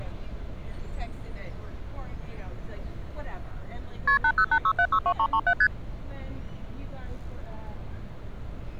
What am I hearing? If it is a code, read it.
Multi-frequency trunk signalling (R1, as on North American trunks), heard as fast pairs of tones, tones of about 70 ms, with street noise. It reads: KP 8086762337 ST